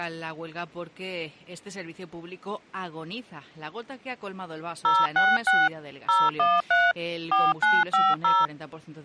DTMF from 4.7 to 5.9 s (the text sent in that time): 066